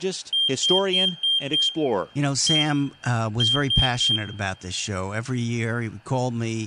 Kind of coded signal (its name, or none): beep code